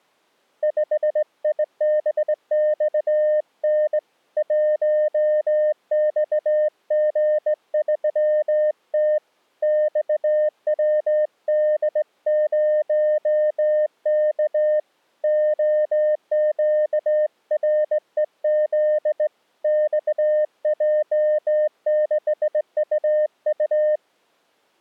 Morse code, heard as a keyed tone, hand-sent with a straight key, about 18 wpm, 610 Hz. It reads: 5IBXN 1XG3T XWD0K OQREZ XJ6UU